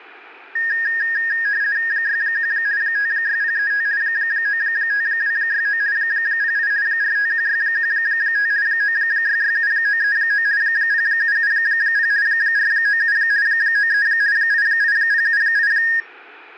RTTY (50 baud, 170 Hz shift), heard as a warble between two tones, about 1750 Hz centre. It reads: 61 56035 95269 08 451615 9667939 0770 497 93 88078